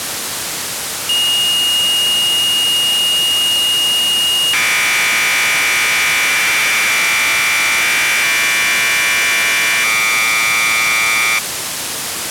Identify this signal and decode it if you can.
Commodore tape loading (standard loader), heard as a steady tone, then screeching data, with tape hiss.